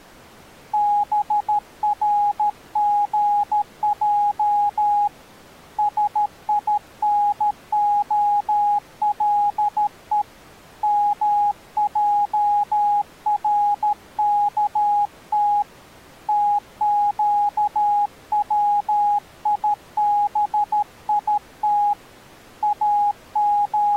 Morse code (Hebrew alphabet), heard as a keyed tone, hand-sent with a paddle, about 13 wpm, 820 Hz. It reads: ברגע שינהלו מערכת תקציבית …